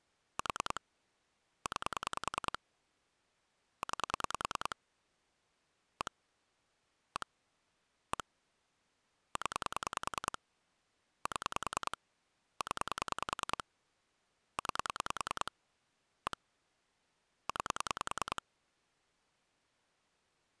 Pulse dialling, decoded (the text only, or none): 4 9 9 1 1 1 0 7 0 9 1 9